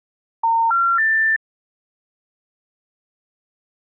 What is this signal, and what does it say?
Telephone call progress tone (North American plan), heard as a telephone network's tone, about 910, 1370, 1800 Hz. Special information tone.